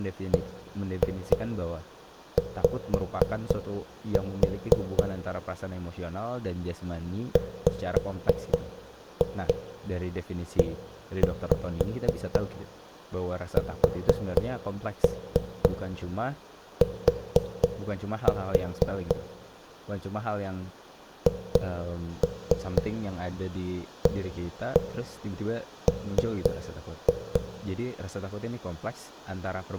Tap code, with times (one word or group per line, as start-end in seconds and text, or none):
0.3-5.0 BY
7.4-19.2 WEST
21.3-27.4 HAM